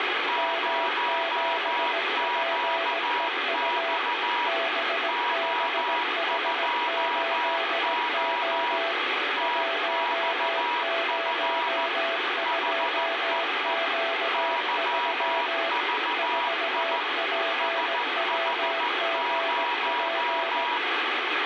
Morse code, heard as two keyed tones, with radio static. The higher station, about 14 wpm, 960 Hz: 0QX O2O TXF HEE YVI SH0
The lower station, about 17 wpm, 670 Hz: M7PEU BBH8O 102Q3 4PWGP